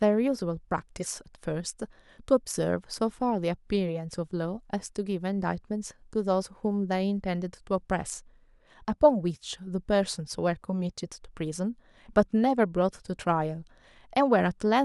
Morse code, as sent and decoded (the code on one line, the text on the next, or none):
none